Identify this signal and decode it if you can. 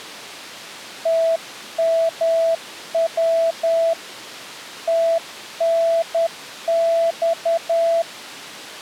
Morse code, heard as a keyed tone, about 10 wpm, 660 Hz. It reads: TMW TNX